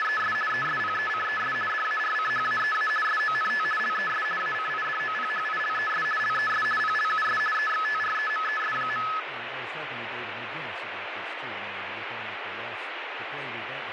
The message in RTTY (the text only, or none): … ESPECES DARCHAEA SONT LES ACIDOPHILES LES PLUS EXTREMES.